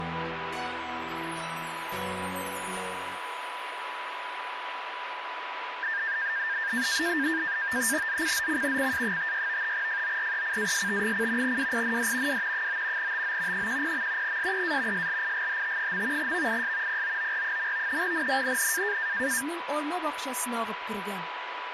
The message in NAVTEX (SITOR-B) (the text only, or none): ZCZC CA56 FORECAST: WIND W 9 TO 10. SEA SLIGHT. VIS POOR. NNNN